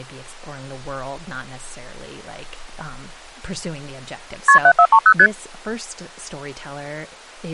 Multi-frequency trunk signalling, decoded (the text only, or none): KP 7430 ST